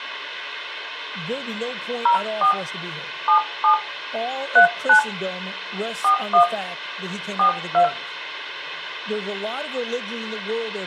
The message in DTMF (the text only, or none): 04 77 39 41 42